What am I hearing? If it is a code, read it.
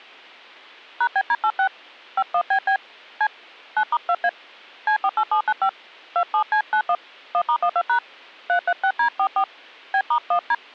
DTMF, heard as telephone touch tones, dialled by hand, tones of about 70 ms. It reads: #BD86 51BB C 9*2A C48795 27C91 1*12# 336D44 B*1D